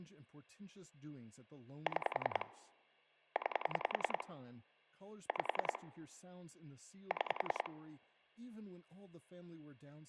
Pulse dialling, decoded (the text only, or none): 6 9 5 6